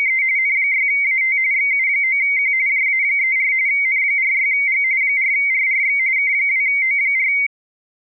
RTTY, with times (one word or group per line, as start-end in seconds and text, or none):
0.0-0.2 …
0.4-1.4 N6AT
1.5-2.5 XU9Q
2.7-3.5 JA34
3.7-4.8 N46G
5.0-6.0 4RRX
6.2-7.3 K2O4